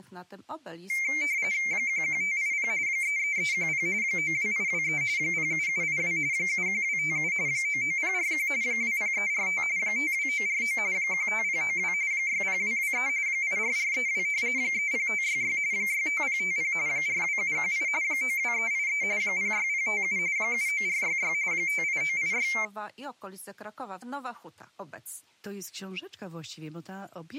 RTTY (45.45 baud, 170 Hz shift), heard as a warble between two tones, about 2200 Hz centre. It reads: 11580 33310 92823 07782 71257 99041 20345 52949 15092 60223 84432 30566 65050 42718 92383 06057 79466 58986